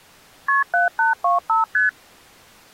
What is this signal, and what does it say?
Multi-frequency trunk signalling (R1, as on North American trunks), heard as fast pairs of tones, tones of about 140 ms. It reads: KP 7825 ST